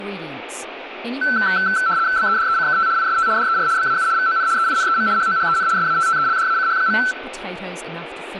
RTTY (75 baud, 170 Hz shift), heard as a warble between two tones, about 1430 Hz centre, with room echo and speech in English. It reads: BEDECKT IST DER BAU VON EINEM HOHEN SATTELDACH.